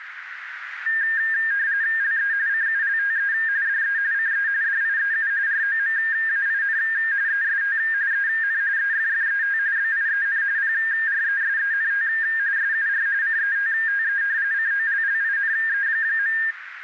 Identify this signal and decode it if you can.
RTTY (45.45 baud, 170 Hz shift), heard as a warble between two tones, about 1700 Hz centre, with radio static and a narrow filter. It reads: LE CULTE DE CE DIEU ROMAIN EST EN EFFET BIEN PRESENT SUR CETTE COLLINE.